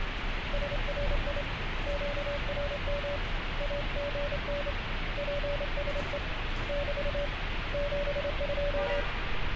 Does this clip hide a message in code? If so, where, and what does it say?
Yes: Morse code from 0.5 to 9.1 s, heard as a keyed tone, hand-sent with a straight key, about 27 wpm, 570 Hz, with heavy radio static and street noise. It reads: SRI QRM AGN PSE <BT> 72